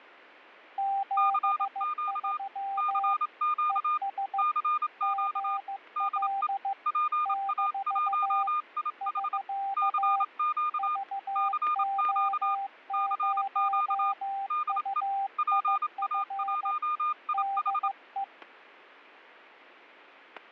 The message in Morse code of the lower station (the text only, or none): 73 ES GL - <SK> VO0UIF DE